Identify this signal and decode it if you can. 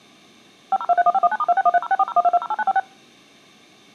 DTMF, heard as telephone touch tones, dialled by machine, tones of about 40 ms. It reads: 50231519*2613064012208956